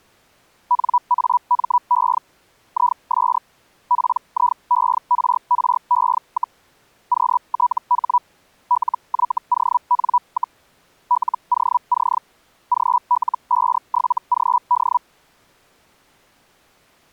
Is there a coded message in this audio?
Yes: Hellschreiber (Feld-Hell, 122.5 baud) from 0.7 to 15.0 s, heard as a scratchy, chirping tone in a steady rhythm, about 980 Hz. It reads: NAME IS PIERRE, QTH LYON, LOC GL57GD